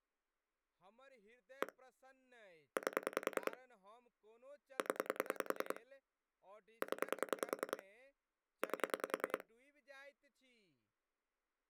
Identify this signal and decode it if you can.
Pulse dialling, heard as clicks on a phone line, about 10 pulses a second, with speech in Maithili. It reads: 1 8 0 0 8